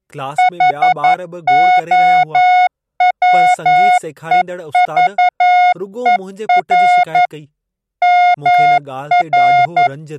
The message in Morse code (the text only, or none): HOWEVER MR